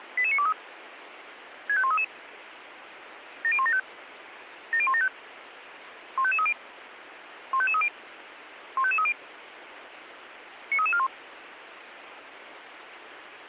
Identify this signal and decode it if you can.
Five-tone selective call (ZVEI), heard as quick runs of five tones, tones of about 70 ms, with radio hiss. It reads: 88923 65133 70175 70175 15530 15530 15530 93341